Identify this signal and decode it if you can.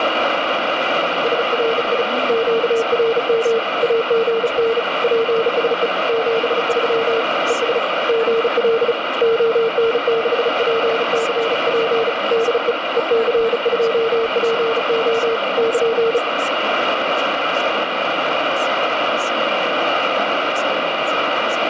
Morse code, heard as a keyed tone, hand-sent with a bug key, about 35 wpm, 460 Hz, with heavy radio static and speech in English. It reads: SRI QRM AGN PSE 73 ES GL ON6PCP DE EC2PO <KN>